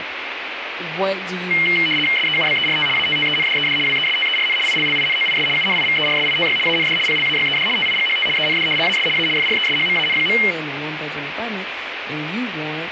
RTTY (75 baud, 850 Hz shift), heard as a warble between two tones, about 2550 Hz centre, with radio static and speech in English. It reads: SEUBERT ATTENDED WESTERN ILLINOIS UNIVERSITY AND PLAYED TIGHT END AS A FRESHMAN.